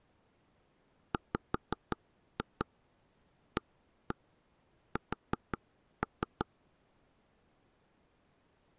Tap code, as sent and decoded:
5-2 1-1 4-3
WAS

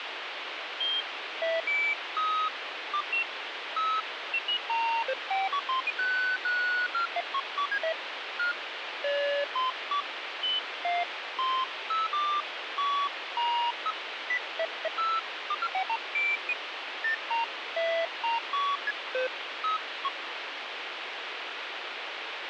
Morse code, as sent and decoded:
none

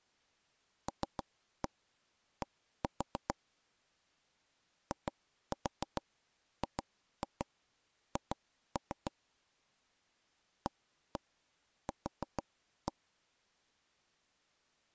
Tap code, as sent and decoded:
3-1 1-4 / 2-4 2-2 2-3 / 1-1 4-1
LD IGH AQ

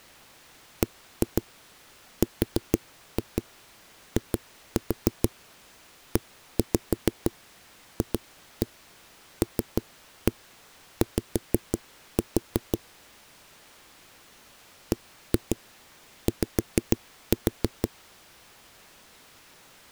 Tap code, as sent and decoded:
1-2 4-2 2-4 1-5 2-1 3-1 5-4 / 1-2 5-4
BRIEFLY BY

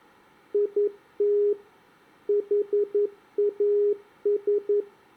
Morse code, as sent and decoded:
.. - / .... .- ...
IT HAS

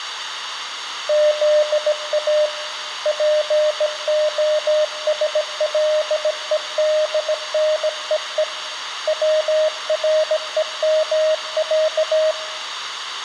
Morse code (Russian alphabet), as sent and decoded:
--.. .- / .--. --- ... .-.. . -.. -. . . / .-- .-. . -- .-.-
ЗА ПОСЛЕДНЕЕ ВРЕМЯ

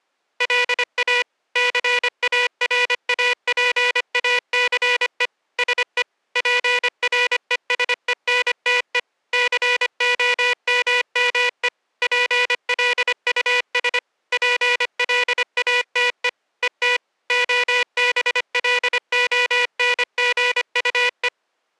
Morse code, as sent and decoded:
.-.. .- / -.-. .- .-. .- .--. .- -.-. . / ... . / .--. .-. . ... . -. - . / -.-. --- -- -- . / .--. .-.. ..- ... / .--. .-.. .- - . / . - / --- -... .-.. --- -. --. ..- .
LA CARAPACE SE PRESENTE COMME PLUS PLATE ET OBLONGUE

